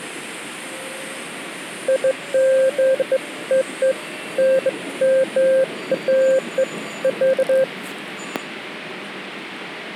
Beeps of irregular length, with the noise inside a subway train. There is no code.